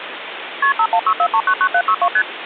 Multi-frequency trunk signalling (R1, as on North American trunks), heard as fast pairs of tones, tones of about 70 ms, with phone line noise. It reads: KP 5164399762 ST